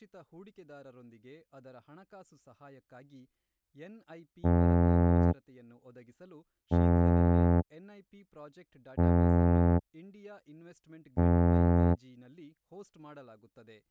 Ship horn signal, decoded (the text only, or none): 4 short